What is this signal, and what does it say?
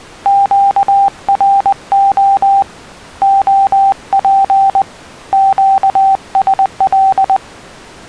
Morse code, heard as a keyed tone, hand-sent with a paddle, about 20 wpm, 780 Hz. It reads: QRO OP QSL